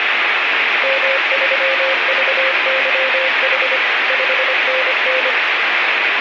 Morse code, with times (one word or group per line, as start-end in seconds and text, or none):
0.8-3.8 M3VYH
4.1-5.3 5NN